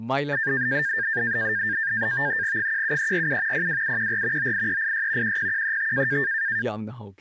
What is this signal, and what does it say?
NAVTEX (SITOR-B), 100 baud, 170 Hz shift, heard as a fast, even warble, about 1700 Hz centre, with speech in Manipuri. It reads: 17347 02714 98386 10135